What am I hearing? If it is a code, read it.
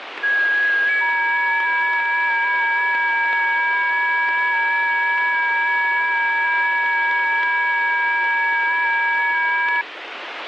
FT8 (several signals at once), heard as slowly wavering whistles, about 6.25 baud, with radio static.